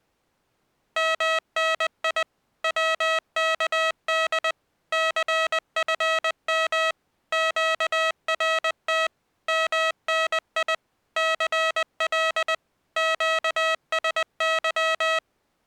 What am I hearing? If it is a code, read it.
Morse code, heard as electronic beeps, machine-sent, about 20 wpm, 640 Hz. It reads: MNI WKD CFM QRT MNI CL QSY